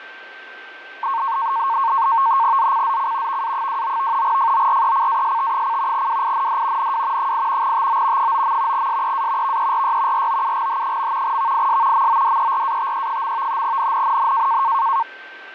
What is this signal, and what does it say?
NAVTEX (SITOR-B), 100 baud, 170 Hz shift, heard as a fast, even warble, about 1000 Hz centre, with a steady whistle near 1560 Hz. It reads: ZCZC VA29 FORECAST: WIND NW 8 TO 9. SEA VERY ROUGH. VIS MODERATE. NNNN